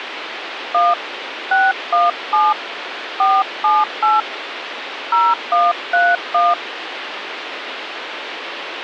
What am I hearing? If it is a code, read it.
DTMF, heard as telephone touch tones, dialled by hand, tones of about 220 ms, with phone line noise. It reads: 1 617 478 0131